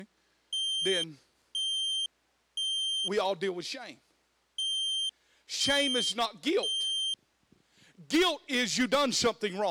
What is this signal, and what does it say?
Alarm pattern, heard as an alarm's beeps, played twice, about 3150 Hz, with speech in English. Temporal three. Smoke or fire, evacuate.